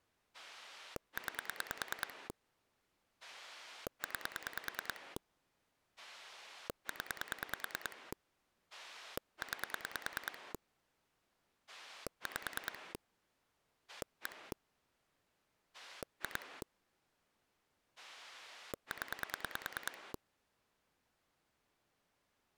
Pulse dialling, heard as a rotary dial, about 9 pulses a second. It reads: 9 9 0 9 5 1 2 0